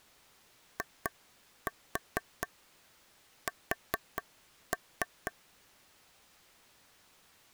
Tap code, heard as taps on a table, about 4 knocks a second. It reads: IS